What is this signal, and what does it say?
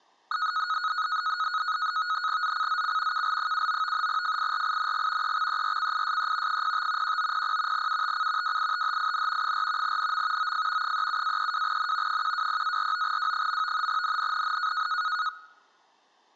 NAVTEX (SITOR-B), 100 baud, 170 Hz shift, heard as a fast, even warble, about 1360 Hz centre. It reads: ZCZC KL79 FIRING EXERCISE 05 1900 UTC WITHIN 4 NM OF 37-32N 120-49W. NNNN